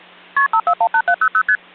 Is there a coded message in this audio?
Yes: multi-frequency trunk signalling (R1, as on North American trunks) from 0.4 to 1.6 s, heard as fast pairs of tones, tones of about 70 ms, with hum. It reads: KP 5418700 ST